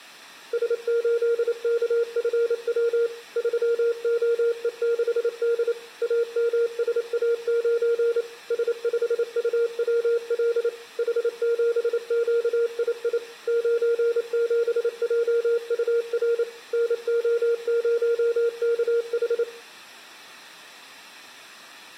Morse code, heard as a keyed tone, machine-sent, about 28 wpm, 470 Hz, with room echo. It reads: S8KFW 3OE6D AMSA9 S5UWL H7QII 97JUR NO0KH